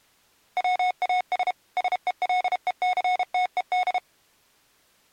Morse code, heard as electronic beeps, machine-sent, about 32 wpm, 730 Hz. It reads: WAS SELECTED